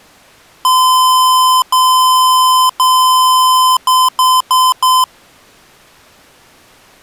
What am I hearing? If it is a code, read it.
Beep code, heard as beeps from a small speaker, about 1020 Hz. 3 long, 4 short.